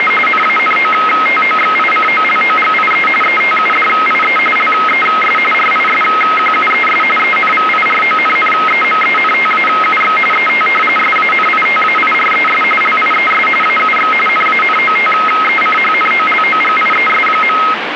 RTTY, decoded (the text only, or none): … NANOTOXICOLOGIE ETUDIE LES RISQUES ENVIRONNEMENTAUX ET SANITAIRES LIES AUX NANOTECHNOLOGIES.